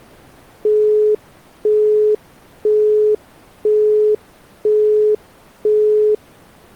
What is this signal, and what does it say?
Telephone call progress tone (single-tone plan, as in Europe, Japan and elsewhere), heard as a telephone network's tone, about 420 Hz, 0.5 s on and 0.5 s off. Busy tone.